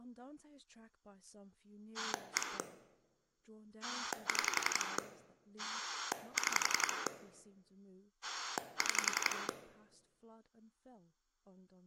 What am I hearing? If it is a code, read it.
Pulse dialling, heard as a rotary dial, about 11 pulses a second, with speech in English. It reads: 1 6 6 6